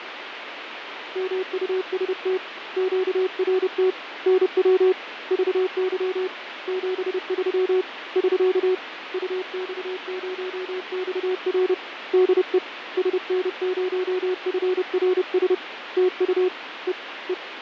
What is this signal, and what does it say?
Morse code, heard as a keyed tone, hand-sent with a paddle, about 30 wpm, 370 Hz, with radio static and fading. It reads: MUST QRT NW VY 73 <SK> UX0XR DE SN0FRS TU E E